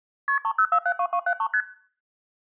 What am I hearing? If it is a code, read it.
Multi-frequency trunk signalling (R1, as on North American trunks), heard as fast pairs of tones, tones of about 70 ms. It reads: KP 30472273 ST